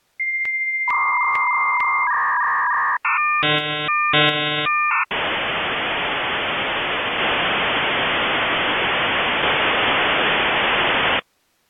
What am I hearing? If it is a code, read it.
Dial-up modem handshake (V.34 or later), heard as a whistle, warbles, then hiss.